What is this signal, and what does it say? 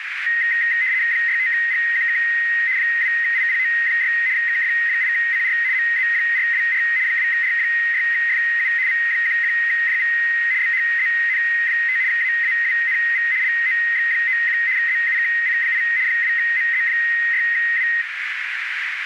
RTTY (75 baud, 170 Hz shift), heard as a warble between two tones, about 1950 Hz centre, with radio static and a narrow filter. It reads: 65GQK 2IPO6 KF8CR MZ424 2R6FU V11JV BHZN5 AAWNV LOX91 ZUKC8 2MZ6W